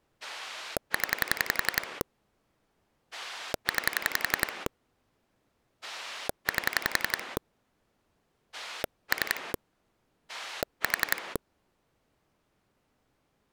Pulse dialling, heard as a rotary dial, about 11 pulses a second. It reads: 0 9 8 3 4